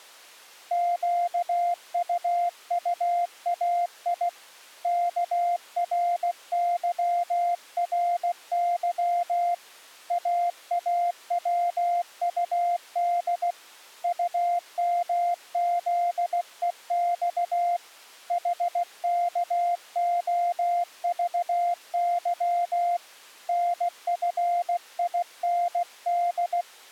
Morse code, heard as a keyed tone, hand-sent with a paddle, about 16 wpm, 700 Hz. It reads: QUUAI KRYRY AAWUD UMZEX HKOVY NFIND